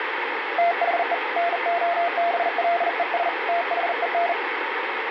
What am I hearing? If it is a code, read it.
Morse code, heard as a keyed tone, hand-sent with a bug key, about 40 wpm, 690 Hz, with radio static. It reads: THE NOBLES THEN